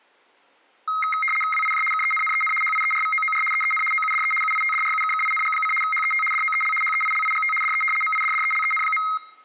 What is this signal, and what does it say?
RTTY (75 baud, 850 Hz shift), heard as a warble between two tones, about 1700 Hz centre, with room echo. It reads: WIJ KENNEN HIERVOOR EEN OUDE UITDRUKKING: HET DOEL HEILIGT DE MIDDELEN.